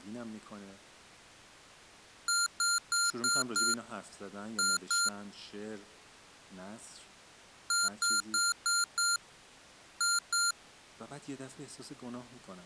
Beep code, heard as beeps from a small speaker, played twice, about 1390 Hz, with speech in Persian. 5-2.